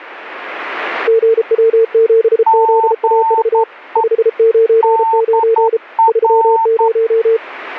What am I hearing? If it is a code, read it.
Morse code, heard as two keyed tones. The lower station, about 33 wpm, 450 Hz: GW7ZAV 599 30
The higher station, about 11 wpm, 900 Hz: GE DR